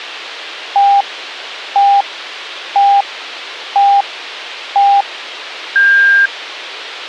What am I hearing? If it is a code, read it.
Radio time signal (five pips and a higher one, as on Chinese radio), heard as pips.